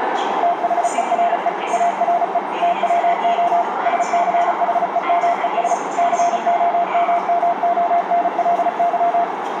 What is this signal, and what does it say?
Morse code, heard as a keyed tone, machine-sent, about 35 wpm, 690 Hz, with radio static, a narrow filter and the noise of a subway station. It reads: THERE ARE TWO SCHEMES COMMONLY